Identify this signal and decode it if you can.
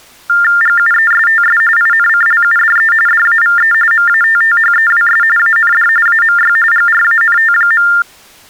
TTY/TDD text telephone tones (45.45 baud Baudot), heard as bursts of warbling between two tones, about 400 Hz shift, 1600 Hz centre. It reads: GUESTS INCLUDE DAVE MATTHEWS AND AMY GRANT.